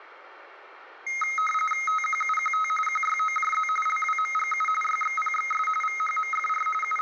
RTTY (45.45 baud, 850 Hz shift), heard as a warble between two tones, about 1700 Hz centre, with radio static and room echo. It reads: TQUQT QYOJZ LWMGU YXPXS VHMFR …